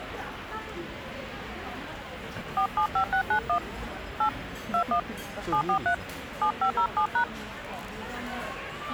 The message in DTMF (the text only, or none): 475691 8 21 743 7507#